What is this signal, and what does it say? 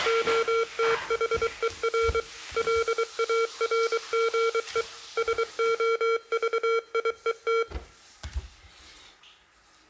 Morse code, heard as electronic beeps, machine-sent, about 23 wpm, 460 Hz, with room echo and the noise of a restroom. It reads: OTHER LARGE SOVIET